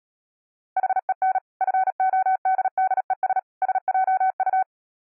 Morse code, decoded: HEN FODDES SJU

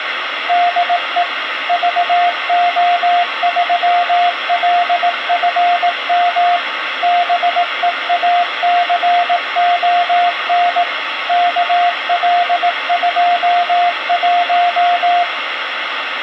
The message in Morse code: DE VO3LFM BEACON KL21

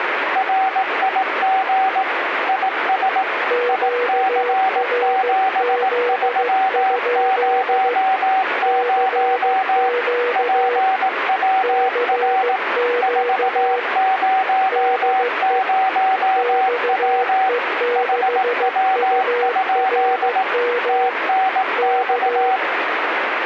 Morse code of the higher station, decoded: RIG IS IC7300 PWR 400W HW? TNX

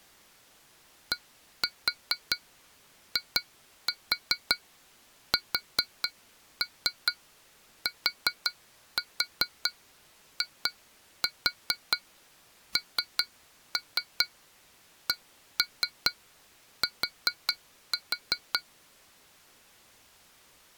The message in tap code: DISTINCT

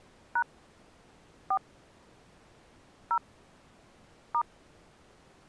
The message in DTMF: # 4 0 *

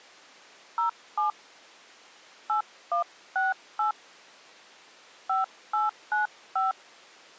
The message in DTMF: 07 8168 5895

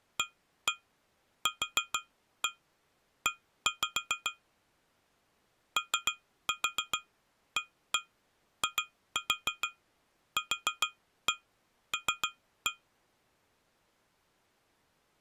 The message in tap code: AQE OAIQL

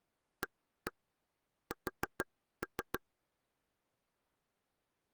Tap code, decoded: AS

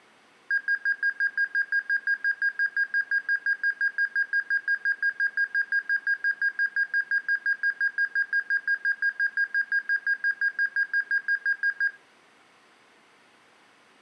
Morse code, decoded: none

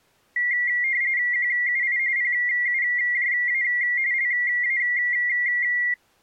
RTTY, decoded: QUI PUJA LA

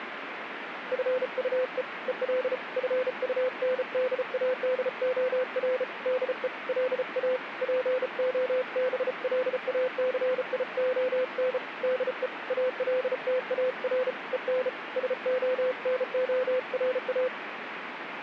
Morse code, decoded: FUE EL FUNDADOR DE LA POBLACION DE ALTAR EN SONORA

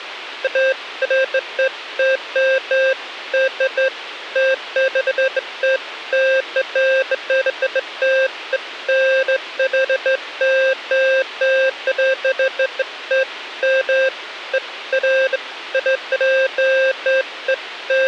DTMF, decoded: none

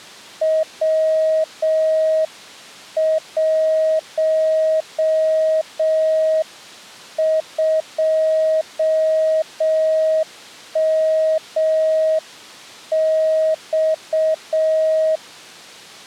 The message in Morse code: W12MX

